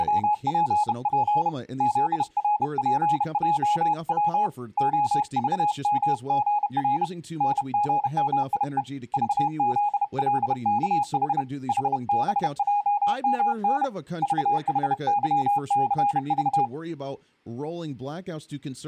Morse code, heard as a keyed tone, hand-sent with a bug key, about 31 wpm, 830 Hz, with speech in English. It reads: … ZRPJW OVMGR NGMIE VZLKH HBJMN VHYCV